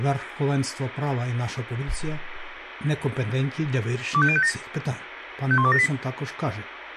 Five-tone selective call (ZVEI), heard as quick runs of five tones, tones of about 70 ms, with radio hiss and a squelch burst at the end. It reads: 25057 51278